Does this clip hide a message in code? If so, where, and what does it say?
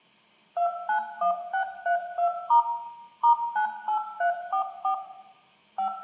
Yes: DTMF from 0.6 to 5.9 s, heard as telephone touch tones, dialled by machine, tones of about 100 ms, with room echo. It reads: 291632* *98344 5